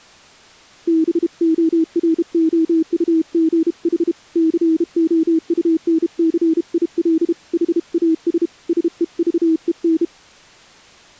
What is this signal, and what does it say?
Morse code, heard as a keyed tone, hand-sent with a bug key, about 32 wpm, 320 Hz. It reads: BOROUGH COUNCIL HAS SEVEN